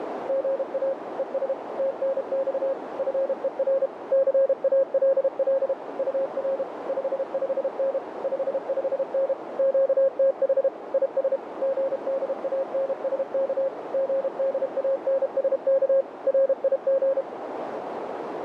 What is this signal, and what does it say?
Morse code, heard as a keyed tone, machine-sent, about 32 wpm, 540 Hz, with radio static and a narrow filter. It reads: GA ES TNX FER CALL UR 55N 55N QTH IS GDANSK GDANSK RIG